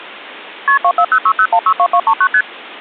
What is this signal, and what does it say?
Multi-frequency trunk signalling (R1, as on North American trunks), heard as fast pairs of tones, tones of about 70 ms. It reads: KP 24060162239 ST